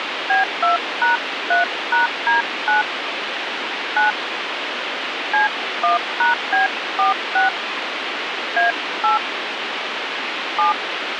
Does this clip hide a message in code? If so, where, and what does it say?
Yes: DTMF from 0.3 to 10.7 s, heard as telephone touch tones, dialled by hand, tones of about 140 ms, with radio hiss. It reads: B2#3#D9 9 C1#B46 A8 7